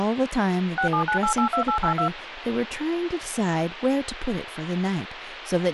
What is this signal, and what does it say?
DTMF, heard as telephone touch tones, dialled by machine, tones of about 100 ms, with phone line noise and speech in English. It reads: 679882882